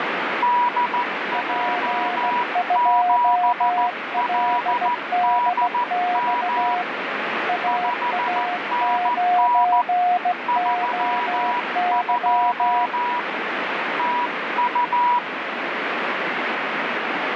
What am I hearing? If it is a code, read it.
Morse code, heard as two keyed tones, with heavy radio static. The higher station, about 14 wpm, 970 Hz: DJ7LDM 5NN 32 TU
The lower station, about 17 wpm, 720 Hz: P2LDX AA9OY